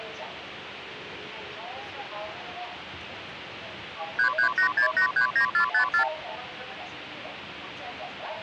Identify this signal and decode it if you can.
Multi-frequency trunk signalling (R2, with the far end's replies), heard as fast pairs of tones, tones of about 100 ms, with phone line noise and the noise inside a subway train. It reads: 3386839454